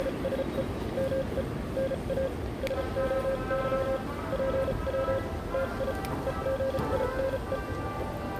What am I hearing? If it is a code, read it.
Morse code (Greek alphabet), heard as a keyed tone, machine-sent, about 34 wpm, spaced as for 29 wpm, 540 Hz, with the noise of a subway station. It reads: … ΜΕ ΝΑ ΣΟΥ ΠΩ ΤΙ ΕΓΙΝΕ